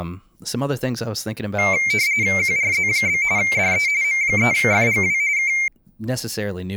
RTTY (45.45 baud, 170 Hz shift), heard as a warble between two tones, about 2200 Hz centre, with speech in English. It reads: QRZ? DE M3FGW K